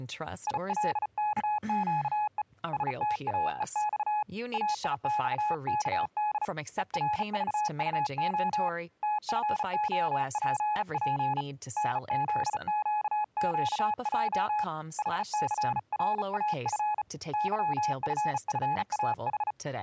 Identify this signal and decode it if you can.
Morse code, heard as a keyed tone, hand-sent with a bug key, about 35 wpm, 840 Hz, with speech in English. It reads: ILKQE STAEX AIXKD ERVUO TFOPP NZQQJ HCRAF YFFAH